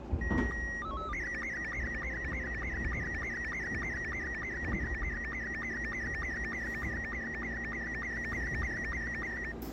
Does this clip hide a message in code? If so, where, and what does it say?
Yes: SSTV (slow-scan television), Robot 72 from 0.2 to 9.5 s, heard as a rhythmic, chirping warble, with the noise inside a subway train.